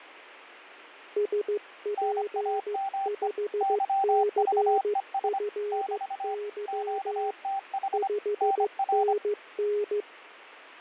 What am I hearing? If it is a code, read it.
Morse code, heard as two keyed tones, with radio static and fading. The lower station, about 15 wpm, 420 Hz: SP5CFY 5NN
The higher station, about 25 wpm, 780 Hz: NAME YVES <BT> QTH NR